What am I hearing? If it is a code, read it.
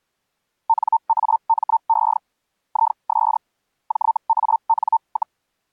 Hellschreiber (Feld-Hell, 122.5 baud), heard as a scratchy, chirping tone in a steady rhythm, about 900 Hz. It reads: NAME IS JAN,